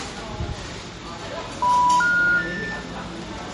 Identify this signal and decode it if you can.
Telephone call progress tone (North American plan), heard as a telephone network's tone, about 980, 1430, 1800 Hz, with room echo and the noise of a cafe. Special information tone.